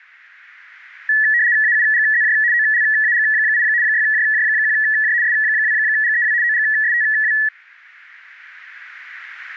RTTY (75 baud, 170 Hz shift), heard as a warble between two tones, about 1800 Hz centre. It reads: AUGZJ OLAG8 6JJ1J S2GEW OGSTW